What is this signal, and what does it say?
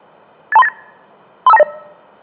Five-tone selective call (EIA), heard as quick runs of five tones, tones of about 30 ms. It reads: 82398 35290